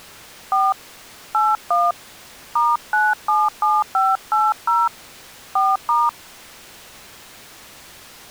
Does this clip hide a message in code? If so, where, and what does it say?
Yes: DTMF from 0.5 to 6.1 s, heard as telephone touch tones, dialled by hand, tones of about 200 ms. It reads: 4 81 *977580 4*